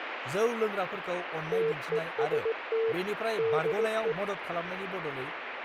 Morse code, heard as a keyed tone, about 18 wpm, 450 Hz, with radio static and speech in Bodo. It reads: TEST DE